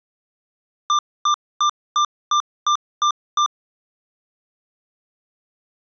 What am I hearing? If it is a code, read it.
Beep code, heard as beeps from a small speaker, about 1190 Hz. 8 short. In AMI BIOS tables: display memory failure; in Dell tables: LCD failure.